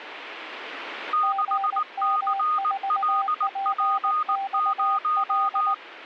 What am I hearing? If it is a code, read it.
Morse code, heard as two keyed tones. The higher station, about 19 wpm, 1240 Hz: 6CLP0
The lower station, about 19 wpm, 780 Hz: GM4PXL